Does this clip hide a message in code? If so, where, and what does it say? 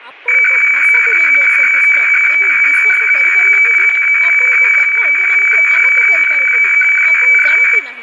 Yes: weather fax (radiofax), 120 lines a minute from 0.3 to 7.8 s, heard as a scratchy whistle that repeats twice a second, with static crashes, room echo and speech in Odia.